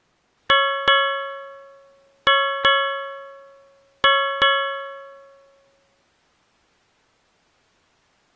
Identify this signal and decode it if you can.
Ship's bell, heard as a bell. 6. Six half-hours of the watch have passed.